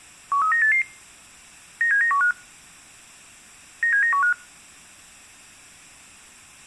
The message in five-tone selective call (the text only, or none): 13988 97915 97915